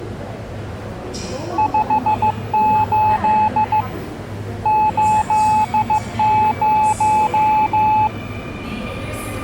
Morse code, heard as a keyed tone, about 15 wpm, 860 Hz, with the noise of a subway station. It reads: 58 80